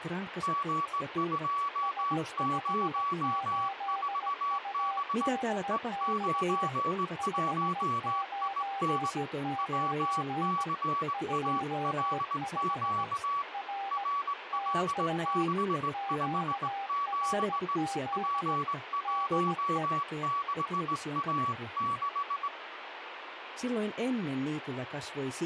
Morse code, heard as two keyed tones, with radio static. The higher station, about 19 wpm, 1140 Hz: G204B E91IN WCALQ RL657 P16A6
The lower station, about 17 wpm, 790 Hz: S58UDX 599 25 R TU QRZ DE